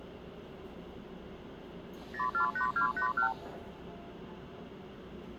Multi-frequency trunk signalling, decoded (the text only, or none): 048281